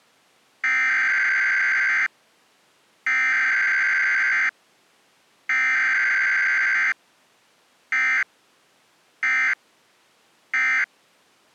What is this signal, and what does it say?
Emergency Alert System (SAME) tones (header bursts, then end-of-message bursts), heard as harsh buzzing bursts, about 520.83 baud.